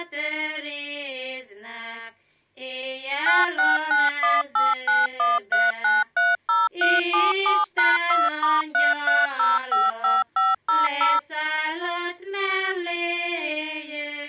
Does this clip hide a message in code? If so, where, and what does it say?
Yes: DTMF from 3.3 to 11.2 s, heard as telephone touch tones, dialled by machine, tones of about 190 ms. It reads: 96918913930377#2*33055500